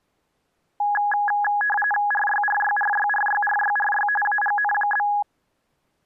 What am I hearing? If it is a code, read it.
RTTY (45.45 baud, 850 Hz shift), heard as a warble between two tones, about 1250 Hz centre. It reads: RYRYRYRYRYRY AGN?